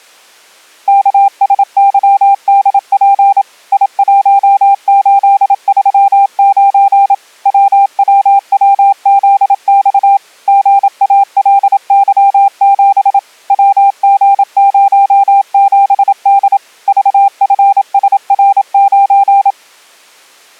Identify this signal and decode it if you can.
Morse code, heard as a keyed tone, machine-sent, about 27 wpm, 800 Hz. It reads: KSYDP I1839 WWWZX GALY7 WG07D VFSR9